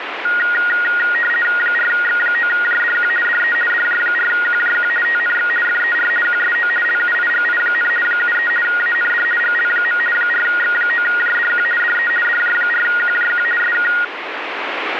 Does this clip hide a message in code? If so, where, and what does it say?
Yes: RTTY (50 baud, 450 Hz shift) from 0.2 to 14.0 s, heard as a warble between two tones, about 1650 Hz centre, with radio static. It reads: 4X9JDQ DE DJ4QJQ TNX FER QSO LUIGI, 73 AND GL. 4X9JDQ DE DJ4QJQ SK